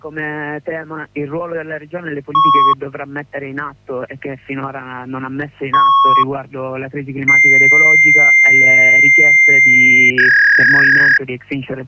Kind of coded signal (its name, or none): fax machine handshake